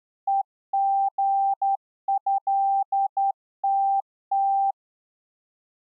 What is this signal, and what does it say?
Morse code (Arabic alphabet), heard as a keyed tone, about 11 wpm, 790 Hz. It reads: ءغهتت